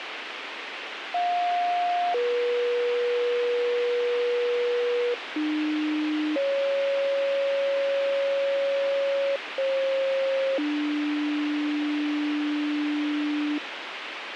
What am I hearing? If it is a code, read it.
Two-tone page, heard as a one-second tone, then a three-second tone, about 710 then 480 Hz, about 300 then 550 Hz, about 540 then 300 Hz, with radio hiss and a squelch burst at the end.